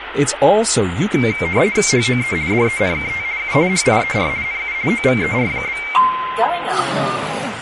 RTTY (50 baud, 170 Hz shift), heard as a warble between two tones, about 2200 Hz centre, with radio static. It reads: HOE DENKT U HIER NU OVER?